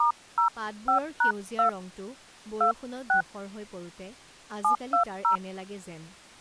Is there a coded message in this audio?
Yes: DTMF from 0.0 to 5.4 s, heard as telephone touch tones, dialled by hand, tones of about 110 ms, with speech in Assamese. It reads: *05#2 26 720